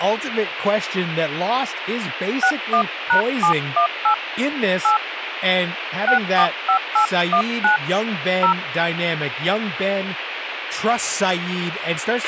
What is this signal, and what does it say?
DTMF, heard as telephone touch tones, dialled by hand, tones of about 100 ms, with radio hiss, a squelch burst at the end and speech in English. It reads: 61#718 8 645819 0